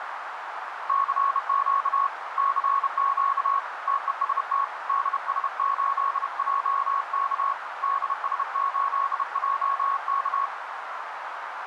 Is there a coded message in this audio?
Yes: Morse code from 0.8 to 10.5 s, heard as a keyed tone, hand-sent with a bug key, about 31 wpm, 1100 Hz, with radio static and a narrow filter. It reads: CQ CQ TEST DS8JK DS8JK